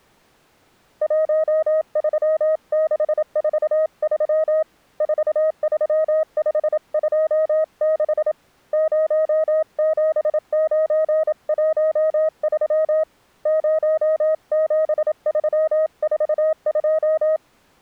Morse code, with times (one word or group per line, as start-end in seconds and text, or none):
1.0-4.6 13643
5.0-8.3 43526
8.7-13.0 07913
13.5-17.4 07342